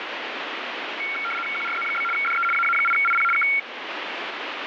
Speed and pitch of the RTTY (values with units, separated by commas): 75 baud, 850 Hz shift, 1800 Hz centre